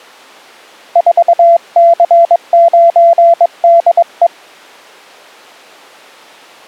Morse code, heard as a keyed tone, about 22 wpm, 680 Hz. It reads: 4C9DE